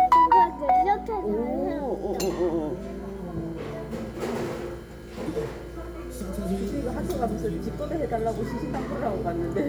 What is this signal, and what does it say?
The noise of a crowd indoors. There is no code.